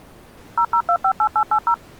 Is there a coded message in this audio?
Yes: DTMF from 0.6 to 1.7 s, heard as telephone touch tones, dialled by machine, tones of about 70 ms. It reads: 00258880